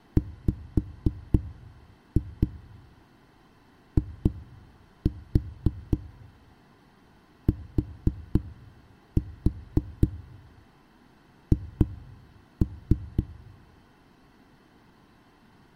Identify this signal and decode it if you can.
Tap code, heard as knocks on a wall, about 3 knocks a second. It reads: WITH